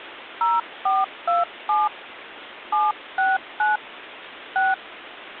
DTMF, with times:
0.4-1.9 0427
2.7-3.8 769
4.6-4.7 6

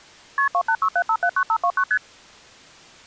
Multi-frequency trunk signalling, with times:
0.4-0.5 KP
0.5-1.8 2867579529
1.9-2.0 ST

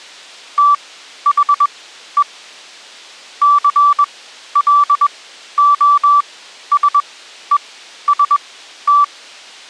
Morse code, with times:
0.6-2.2 THE
3.4-9.0 CLOSEST

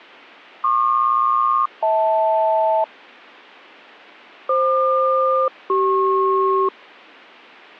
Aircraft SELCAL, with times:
0.6-2.8 PQ-HL
4.5-6.7 FQ-CP

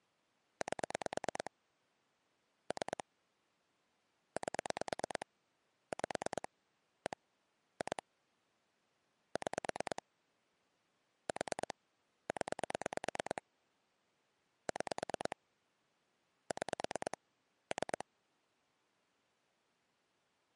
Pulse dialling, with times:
0.6-1.5 8
2.7-3.0 3
4.4-5.3 8
5.9-6.5 5
7.1-7.2 1
7.8-8.0 2
9.4-10.0 6
11.3-11.7 4
12.3-13.4 0
14.7-15.4 6
16.5-17.2 6
17.7-18.1 3

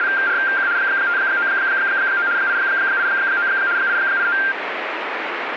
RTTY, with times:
0.0-0.7 …
0.8-2.3 599
2.4-3.5 889
3.8-4.4 889

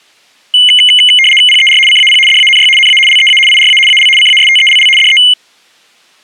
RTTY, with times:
1.5-1.8 PER
1.9-2.2 CAP
2.3-2.7 DANY
2.8-3.0 NA
3.1-3.4 LEA
3.5-3.8 IRA
3.9-4.1 AL
4.2-4.9 CASTELL
5.0-5.2 DE

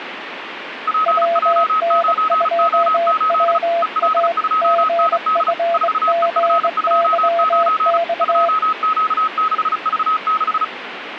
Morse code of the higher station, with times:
0.9-3.6 PJ9O8
3.8-5.5 EL2ND
5.7-8.0 4EF29
8.2-10.6 2Q6V6

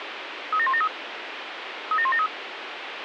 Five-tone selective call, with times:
0.5-0.9 37173
1.9-2.3 37173

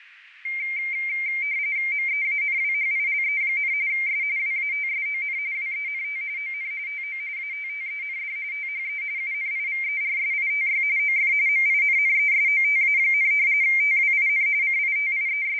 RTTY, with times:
1.9-3.7 MEANWHILE,
3.9-4.2 S
4.4-5.4 WATSON
5.5-6.2 WENT
6.4-6.7 ON
6.9-7.2 TO
7.4-8.4 ATTEND
8.5-9.0 THE
9.2-10.8 UNIVERSITY
11.0-11.3 OF
11.5-13.3 MINNESOTA,
13.6-14.5 TWIN
14.6-15.6 …

